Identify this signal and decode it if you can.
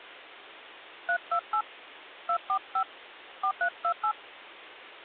DTMF, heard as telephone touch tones, dialled by hand, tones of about 80 ms. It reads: 328 245 4328